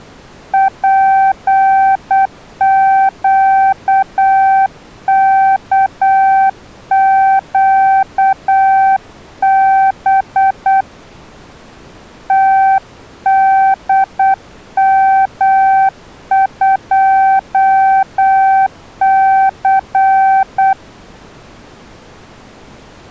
Morse code, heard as a keyed tone, hand-sent with a paddle, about 8 wpm, 770 Hz. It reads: PQKQB TDM2C